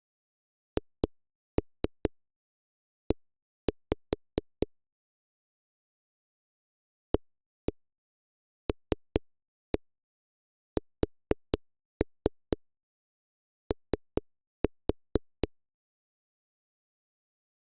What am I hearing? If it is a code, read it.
Tap code, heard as knocks on a wall, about 4 knocks a second. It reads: HE ALSO